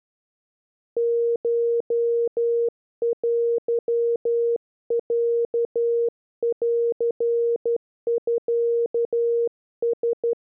Morse code (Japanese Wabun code), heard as a keyed tone, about 12 wpm, 470 Hz. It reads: コテロンミラ